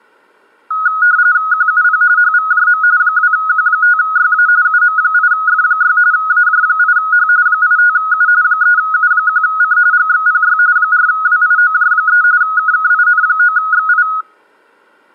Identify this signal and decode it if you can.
RTTY (45.45 baud, 170 Hz shift), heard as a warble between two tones, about 1360 Hz centre. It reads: QUP HVJM 2Q5YA UM8F6 AJ8H 85U 3U1C GXPY 4WIOJ3 KKIN9XI